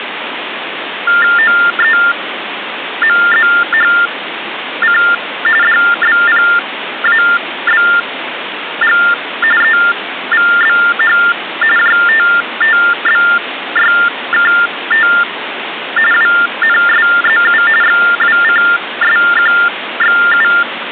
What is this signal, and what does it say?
TTY/TDD text telephone tones (45.45 baud Baudot), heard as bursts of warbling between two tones, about 400 Hz shift, 1600 Hz centre, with phone line noise. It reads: OEMZHC DBPABG EVBH JTTBYKT WNSZU XWCSQXU